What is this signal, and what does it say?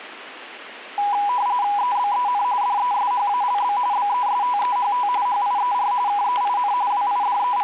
RTTY (45.45 baud, 170 Hz shift), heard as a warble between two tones, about 900 Hz centre, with static crashes. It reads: EBEN DESHALB BESTEHT HIER KEIN …